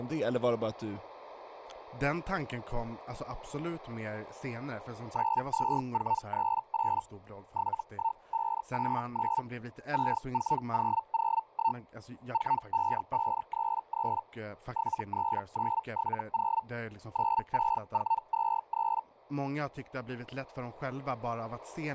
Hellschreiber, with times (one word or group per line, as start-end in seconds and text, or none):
5.1-7.0 92438
7.5-9.4 71589
9.9-11.8 64001
12.3-14.2 45533
14.7-16.6 73970
17.1-19.0 96423